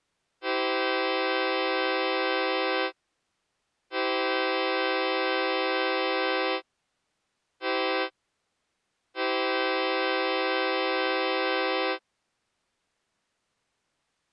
Train horn signal, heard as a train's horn. 2 long, 1 short, 1 long. On North American railways: approaching a public crossing.